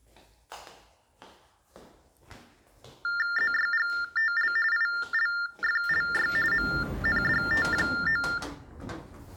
TTY/TDD text telephone tones (45.45 baud Baudot), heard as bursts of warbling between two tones, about 400 Hz shift, 1600 Hz centre, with the noise inside a lift. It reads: ZYGTL ILFLY MNDT9